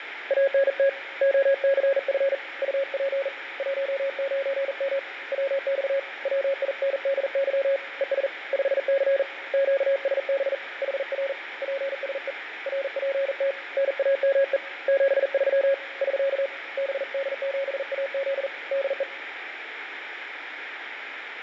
Morse code, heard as a keyed tone, hand-sent with a bug key, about 40 wpm, 550 Hz, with radio static and fading. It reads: ANT OCF UP 19M WX WINDY ES 5C QSB HR PSE RPT NAME 73 <SK> BD7AZ DE